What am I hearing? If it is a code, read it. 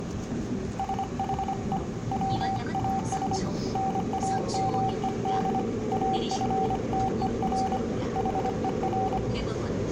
Morse code, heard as a keyed tone, hand-sent with a paddle, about 25 wpm, 770 Hz, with room echo and the noise inside a subway train. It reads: SHE WAS NAMED AFTER HER